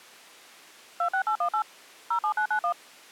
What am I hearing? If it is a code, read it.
DTMF, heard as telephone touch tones, dialled by machine, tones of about 90 ms. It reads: 26818 07991